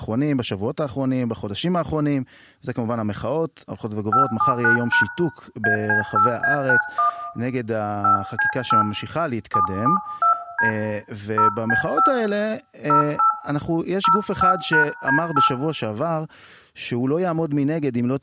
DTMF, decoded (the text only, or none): 579# AC8A91 5C8 772D 0B5 08 05#D8